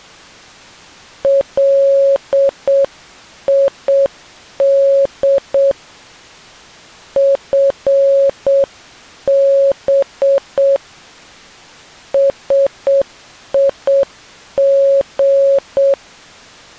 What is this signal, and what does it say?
Morse code, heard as a keyed tone, hand-sent with a straight key, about 7 wpm, 550 Hz. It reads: LID FB SIG